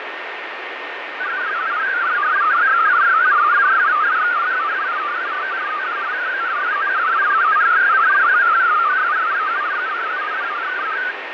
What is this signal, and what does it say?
Multi-tone FSK (Olivia or MFSK type), about 500 Hz wide, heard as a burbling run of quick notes, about 62.5 baud, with radio static, fading and a steady whistle near 1830 Hz.